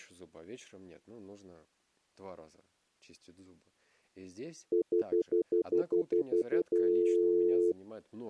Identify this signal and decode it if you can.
Telephone call progress tone (North American plan), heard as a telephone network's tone, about 350, 440 Hz, 0.1 s on and 0.1 s off, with speech in Russian. Stutter dial tone.